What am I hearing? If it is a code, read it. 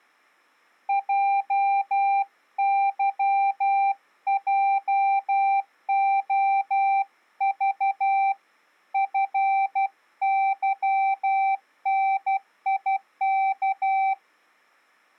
Morse code, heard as a keyed tone, hand-sent with a paddle, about 12 wpm, 780 Hz. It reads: JYJOV FYNIK